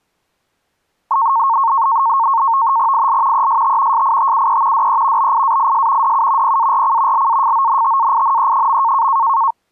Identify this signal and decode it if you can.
NAVTEX (SITOR-B), 100 baud, 170 Hz shift, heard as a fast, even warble, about 1000 Hz centre. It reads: IL EST SITUE DE BIAIS DU PARC LAFONTAINE.